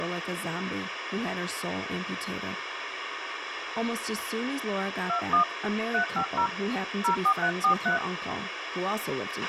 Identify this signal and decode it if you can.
DTMF, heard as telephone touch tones, dialled by hand, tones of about 100 ms, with radio hiss, a squelch burst at the end and speech in English. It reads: 21 350 04343